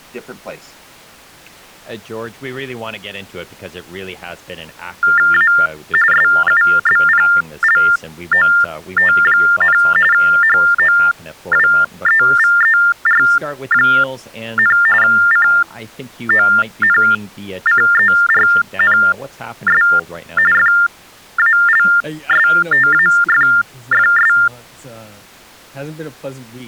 TTY/TDD text telephone tones (45.45 baud Baudot), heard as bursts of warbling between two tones, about 400 Hz shift, 1600 Hz centre, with speech in English. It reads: A SUBPLOT, HOWEVER, CONCERNS FALSTAFFS